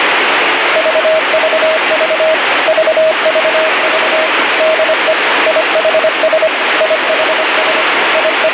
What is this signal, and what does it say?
Morse code, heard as a keyed tone, machine-sent, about 25 wpm, 640 Hz, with heavy radio static. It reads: VVV VVV DE IHS IHS …